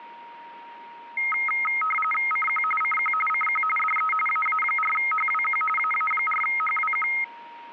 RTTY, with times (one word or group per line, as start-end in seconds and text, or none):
2.3-2.6 CQ
2.8-3.1 CQ
3.3-3.6 CQ
3.8-4.1 DE
4.3-5.6 AA4HWQ
5.8-7.1 AA4HWQ